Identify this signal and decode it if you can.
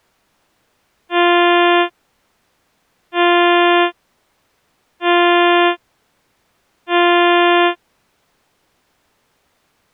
Ship horn signal, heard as a ship's horn, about 350 Hz. 4 short. At sea: a pilot vessel's identity signal in fog.